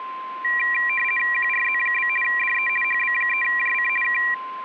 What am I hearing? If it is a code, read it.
RTTY (50 baud, 450 Hz shift), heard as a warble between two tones, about 2150 Hz centre, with a steady whistle near 1040 Hz. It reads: QRZ? DE HB3JC K